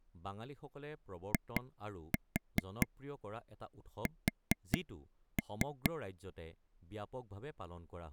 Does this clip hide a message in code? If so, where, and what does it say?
Yes: tap code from 1.3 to 5.9 s, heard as taps on a table, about 4 knocks a second, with speech in Assamese. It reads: IS